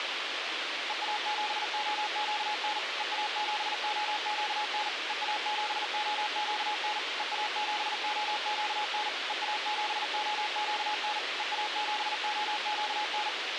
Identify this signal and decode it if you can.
Morse code, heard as a keyed tone, machine-sent, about 40 wpm, 840 Hz, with radio hiss. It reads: EA7OQN EA7OQN EA7OQN EA7OQN EA7OQN EA7OQN